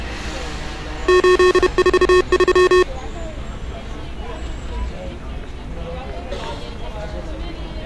Morse code, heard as electronic beeps, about 31 wpm, 360 Hz, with street noise. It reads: 843